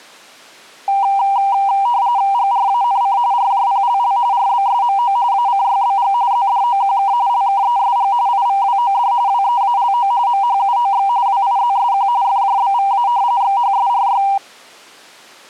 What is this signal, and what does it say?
RTTY (45.45 baud, 170 Hz shift), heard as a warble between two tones, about 880 Hz centre. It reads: GRANC RJPLL RBSMO ACYBG ZDOQK LKESG IVWOD WEALO MHUOX WIZSQ FJBVA XHSRY